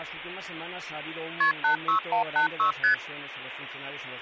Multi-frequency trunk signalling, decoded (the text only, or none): KP 86186 ST